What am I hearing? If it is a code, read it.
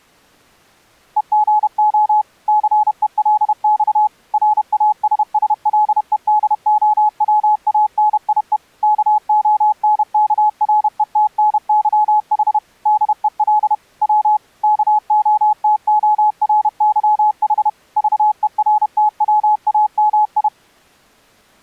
Morse code (Russian alphabet), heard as a keyed tone, machine-sent, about 31 wpm, 850 Hz. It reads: ЕГО ЦЕЛЬ РАССЛЕДОВАНИЕ КОНКРЕТНЫХ ДЕЛ В КОТОРЫХ ЖЕРТВАМИ